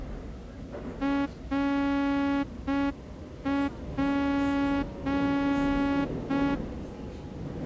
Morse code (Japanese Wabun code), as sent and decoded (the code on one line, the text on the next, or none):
.-. .--.
ナツ